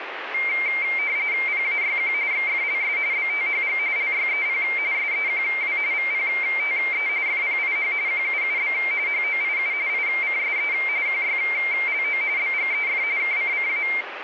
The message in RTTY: PAYQ XFLS BTHG LYEP SEQW VPTE FPIH QUUB HOIU ICSE QYLO BGEF KCCA

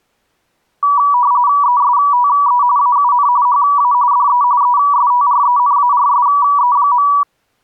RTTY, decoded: ESTE AUN HA DE ESTRENARSE.

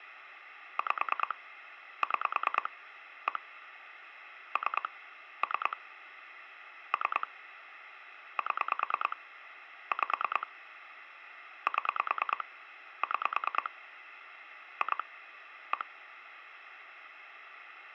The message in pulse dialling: 5 6 1 3 3 3 7 5 7 6 2 1

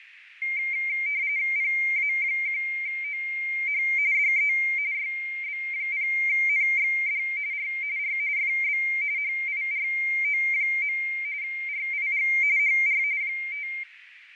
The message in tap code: none

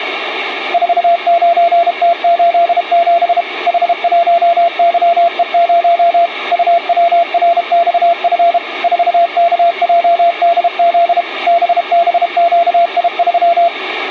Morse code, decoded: 49T87 H1YE0 UWRXF 4KJDZ BBQI3

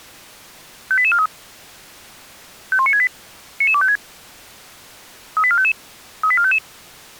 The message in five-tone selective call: 58843 51968 99256 38455 38455

